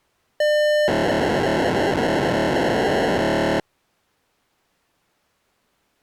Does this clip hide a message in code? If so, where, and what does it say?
Yes: POCSAG pager data (1200 baud) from 0.4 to 3.6 s, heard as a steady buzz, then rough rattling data.